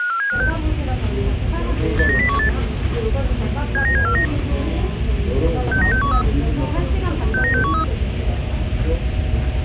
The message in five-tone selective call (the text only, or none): 54756 89018 79749 69613 69613